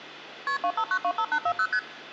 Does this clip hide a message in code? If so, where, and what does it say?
Yes: multi-frequency trunk signalling (R1, as on North American trunks) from 0.5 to 1.8 s, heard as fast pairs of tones, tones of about 70 ms, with hum. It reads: KP 25925840 ST